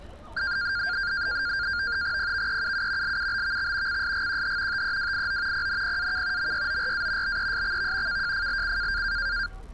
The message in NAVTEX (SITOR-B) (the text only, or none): PVEUU LUBVX CSGQH TEWIO PNPAK MYORA BESXV KJFLC